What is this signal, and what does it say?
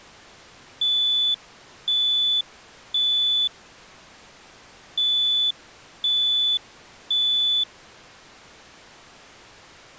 Alarm pattern, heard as an alarm's beeps, played twice, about 3500 Hz. Temporal three. Smoke or fire, evacuate.